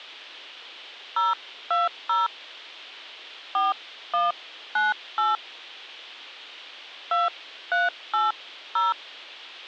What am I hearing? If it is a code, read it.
DTMF, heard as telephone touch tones, dialled by hand, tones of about 170 ms. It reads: 020 4198 2380